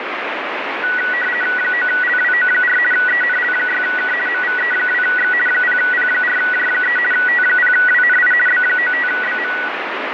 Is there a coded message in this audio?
Yes: RTTY (50 baud, 450 Hz shift) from 0.8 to 9.7 s, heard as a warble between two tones, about 1700 Hz centre, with radio static. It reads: 9LWO4 ENL6K MVE2X 0P4J3 T0WNI B95BM